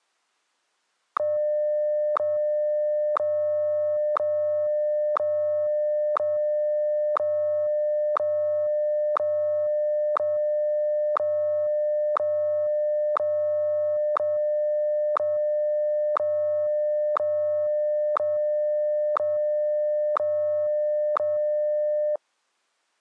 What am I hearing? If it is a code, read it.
Radio time signal (WWVH, Hawaii), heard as ticks, one a second.